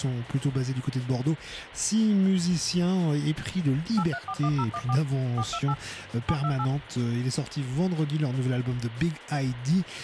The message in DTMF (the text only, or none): 8341014 428 728